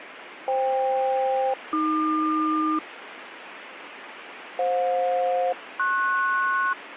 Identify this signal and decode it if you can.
Aircraft SELCAL, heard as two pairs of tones, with radio static. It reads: FK-AQ FJ-PS